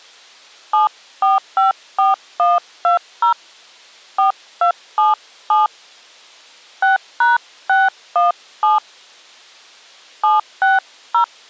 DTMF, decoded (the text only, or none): 7454120 4277 6#617 760